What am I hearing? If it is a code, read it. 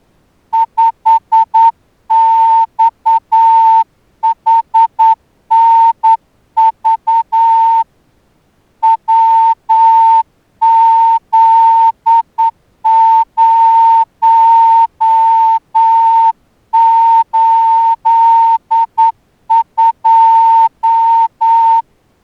Morse code, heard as a whistle, hand-sent with a straight key, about 9 wpm. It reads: 5XHNV WZ082